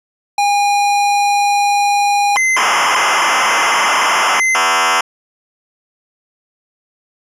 ZX Spectrum tape loading, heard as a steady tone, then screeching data.